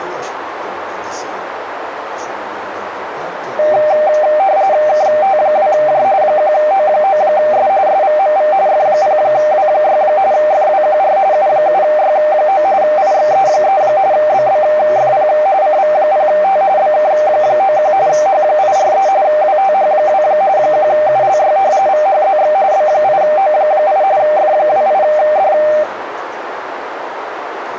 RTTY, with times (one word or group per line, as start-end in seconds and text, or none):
4.9-6.0 KT2J
6.2-7.7 1O9S
7.9-8.5 SVMV
8.7-10.0 F0W6
10.3-11.2 FWQR
11.3-12.6 U7Y9
12.8-13.8 IXE3
14.1-15.3 BBFP
15.6-16.6 CV0T
16.8-17.9 BK91
18.1-19.1 H843
19.2-20.2 WTH2
20.6-21.6 1ULY
21.9-22.5 VHZX
22.7-24.0 B8O8
24.2-25.5 F28D